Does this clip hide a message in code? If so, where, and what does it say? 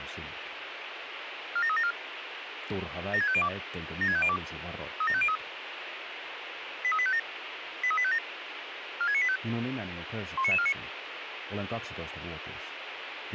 Yes: five-tone selective call (ZVEI) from 1.6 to 10.7 s, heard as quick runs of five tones, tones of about 70 ms, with radio hiss. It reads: 47374 76502 76502 37503 83857 83857 46985 19949